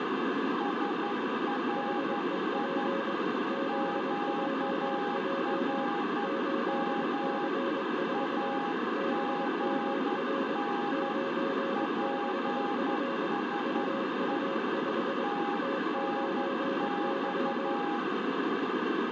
Morse code, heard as two keyed tones, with heavy radio static. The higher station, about 11 wpm, 820 Hz: SRI QRM AGN PSE TNX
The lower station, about 22 wpm, 540 Hz: HEP ZJJ 8C4 BMR 96F UU5 T9Y